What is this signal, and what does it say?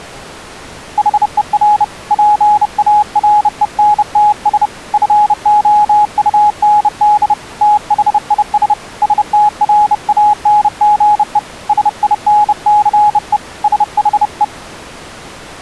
Morse code, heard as a keyed tone, hand-sent with a bug key, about 30 wpm, 840 Hz. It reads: HER PARENTS FOUND THIS STRANGE SINCE SHE